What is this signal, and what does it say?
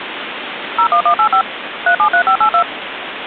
DTMF, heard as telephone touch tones, dialled by machine, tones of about 90 ms, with phone line noise. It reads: 01185 373582